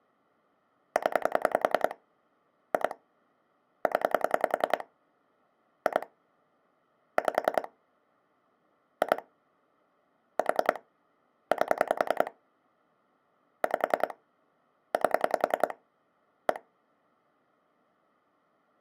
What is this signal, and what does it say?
Pulse dialling, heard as clicks on a phone line, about 10 pulses a second. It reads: 0 2 0 2 5 2 4 8 5 8 1